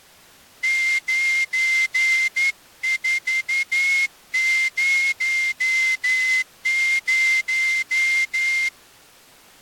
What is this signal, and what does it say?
Morse code, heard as a whistle, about 11 wpm. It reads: 9400